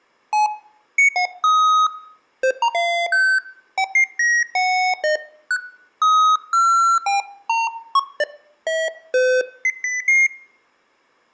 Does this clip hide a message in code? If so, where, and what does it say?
No, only electronic bleeps of random pitch and length.